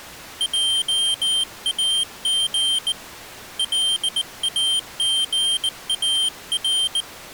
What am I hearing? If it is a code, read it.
Morse code, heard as a high beeper, hand-sent with a bug key, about 19 wpm, 3150 Hz. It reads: JAG LAGAR